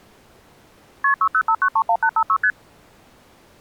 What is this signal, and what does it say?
Multi-frequency trunk signalling (R1, as on North American trunks), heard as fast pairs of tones, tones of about 70 ms. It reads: KP 605931856 ST